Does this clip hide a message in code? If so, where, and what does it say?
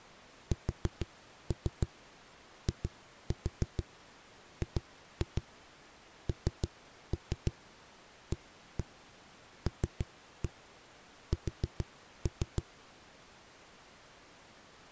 Yes: tap code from 0.5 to 12.7 s, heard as knocks on a wall, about 6 knocks a second. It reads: SIGNALS